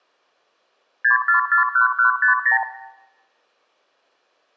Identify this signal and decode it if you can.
Multi-frequency trunk signalling (R2, with the far end's replies), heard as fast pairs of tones, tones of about 120 ms, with room echo. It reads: 6441150